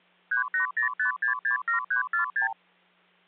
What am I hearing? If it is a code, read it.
Multi-frequency trunk signalling (R2, with the far end's replies), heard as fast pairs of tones, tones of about 110 ms, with hum. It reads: 3805667346